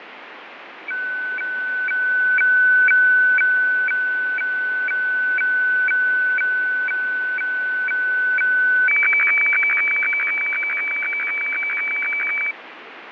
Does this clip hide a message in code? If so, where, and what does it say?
Yes: weather fax (radiofax), 120 lines a minute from 0.9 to 12.5 s, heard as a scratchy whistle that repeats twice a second, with radio static and fading.